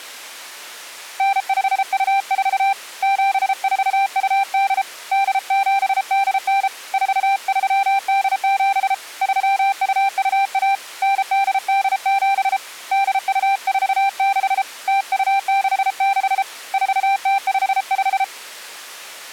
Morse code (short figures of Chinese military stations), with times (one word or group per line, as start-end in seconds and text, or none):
1.2-2.7 9524
3.0-4.8 7428
5.1-6.7 8789
6.9-8.9 4387
9.2-10.7 3221
11.0-12.6 9887
12.9-14.6 8246
14.9-16.4 0266
16.7-18.2 4055